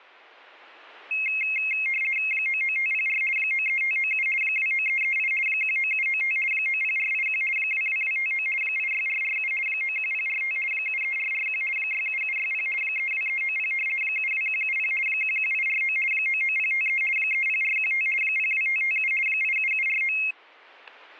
RTTY (50 baud, 450 Hz shift), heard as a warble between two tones, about 2350 Hz centre, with static crashes. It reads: 99504 93597 29338 19795 90481 22259 86447 91045 73441 67760 32390 72170 11849 99053 30415 02557 87749